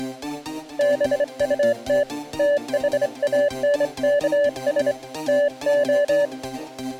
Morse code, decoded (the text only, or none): BUT THANKS TO